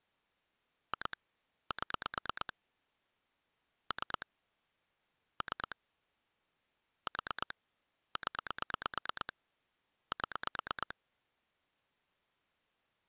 Pulse dialling, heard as clicks on a phone line, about 8 pulses a second. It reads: 2 7 3 3 4 0 7